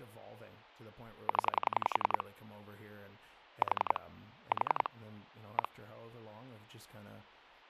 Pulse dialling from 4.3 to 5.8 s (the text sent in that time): 4 1